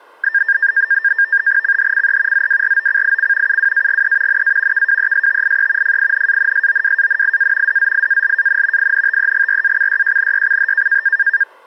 NAVTEX (SITOR-B), 100 baud, 170 Hz shift, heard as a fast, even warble, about 1700 Hz centre. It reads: CHCE ZWROCIC UWAGE NA KWESTIE FINANSOWANIA DZIALAN INTEGRACYJNYCH